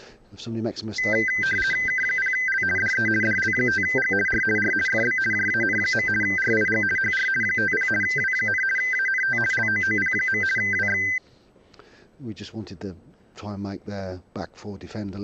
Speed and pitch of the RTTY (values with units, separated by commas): 50 baud, 450 Hz shift, 1800 Hz centre